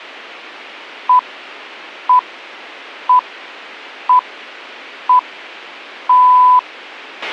Radio time signal (six pips, as the Greenwich Time Signal), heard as pips, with a squelch burst at the end.